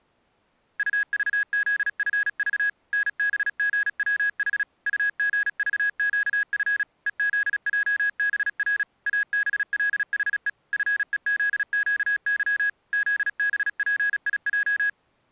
Morse code, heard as electronic beeps, machine-sent, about 36 wpm, 1650 Hz. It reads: UVZFV NBGWH UGVQF EZJBR ABLHE FEZQY ZBPIJ